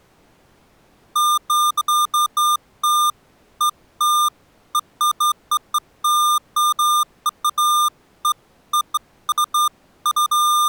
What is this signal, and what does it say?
Beeps of irregular length. There is no code.